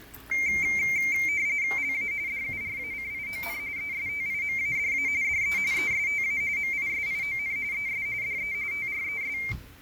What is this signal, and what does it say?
RTTY (45.45 baud, 170 Hz shift), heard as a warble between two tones, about 2200 Hz centre, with fading and the noise of a restaurant. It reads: LA DURACION ESTIMADA DE ESTA MISION ES DE TRES